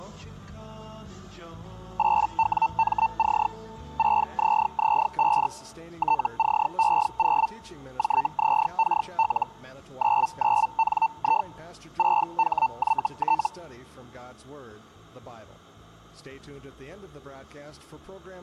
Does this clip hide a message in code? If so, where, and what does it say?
Yes: Hellschreiber (Feld-Hell, 122.5 baud) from 2.0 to 13.5 s, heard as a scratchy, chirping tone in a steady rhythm, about 900 Hz. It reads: 8WMC 6ZZ5 TCE0 JZKL 99NI 6HYT